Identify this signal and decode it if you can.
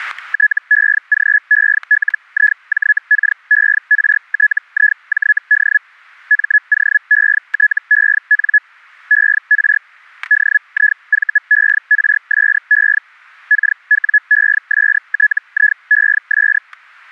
Hellschreiber (Feld-Hell, 122.5 baud), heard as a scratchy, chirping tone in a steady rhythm, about 1700 Hz, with static crashes. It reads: TEGELIJKERTIJD MOETEN ER DIVERSE KWESTIES